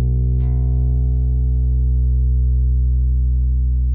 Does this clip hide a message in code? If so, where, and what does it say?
No.